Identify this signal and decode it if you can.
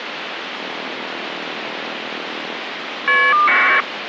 Caller ID data burst, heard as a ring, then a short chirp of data, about 1200 baud, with phone line noise.